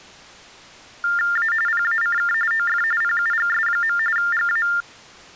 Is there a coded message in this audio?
Yes: TTY/TDD text telephone tones (45.45 baud Baudot) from 1.0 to 4.8 s, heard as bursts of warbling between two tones, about 400 Hz shift, 1600 Hz centre. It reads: A PACK OF PUGS. GA